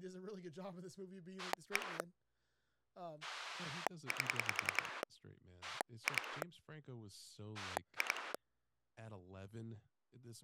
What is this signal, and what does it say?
Pulse dialling, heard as a rotary dial, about 10 pulses a second, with speech in English. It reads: 1 8 2 2